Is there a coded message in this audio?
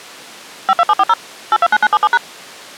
Yes: DTMF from 0.7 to 2.2 s, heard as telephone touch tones, dialled by machine, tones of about 40 ms. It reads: 52740 829977#